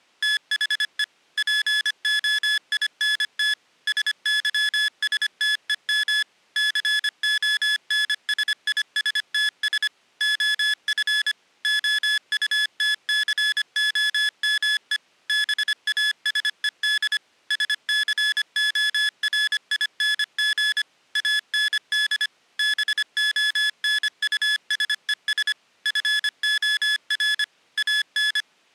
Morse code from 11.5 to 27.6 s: OUTCOME BASED SCORING AND BONUSES FOR

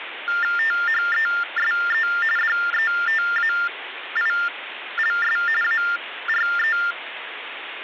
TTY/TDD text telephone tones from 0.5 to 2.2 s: THESE

